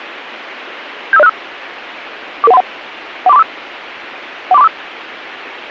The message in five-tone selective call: 75065 44131 14345 14345

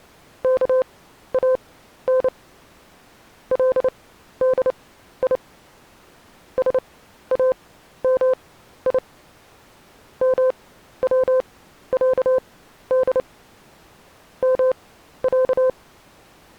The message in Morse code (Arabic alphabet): كان لدي سامي موعد مع

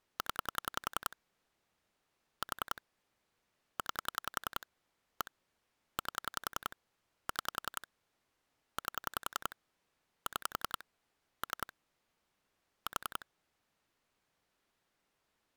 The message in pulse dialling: 0 4 9 1 8 6 8 6 3 4

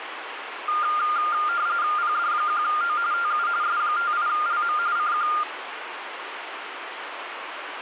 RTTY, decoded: PD1O TU S58LM CQ

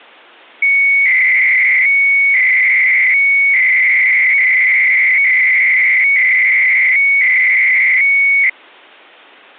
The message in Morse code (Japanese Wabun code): none

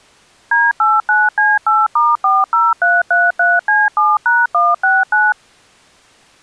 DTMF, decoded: D89C8*40333C7#169

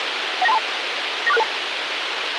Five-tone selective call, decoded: 19232 94662

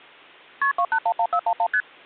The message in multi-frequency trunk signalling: KP 2811411 ST

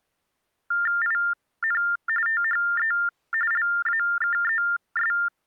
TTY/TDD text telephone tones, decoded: IN THE LAKES

